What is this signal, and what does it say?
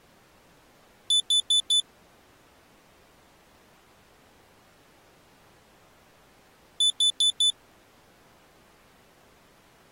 Alarm pattern, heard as an alarm's beeps, played twice, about 3500 Hz. Temporal four. Carbon monoxide.